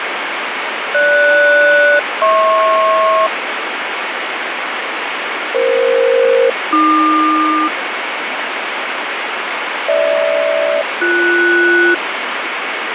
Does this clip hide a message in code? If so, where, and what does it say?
Yes: aircraft SELCAL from 0.9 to 11.9 s, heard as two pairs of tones, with heavy radio static. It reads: GS-HP EF-AQ GH-BS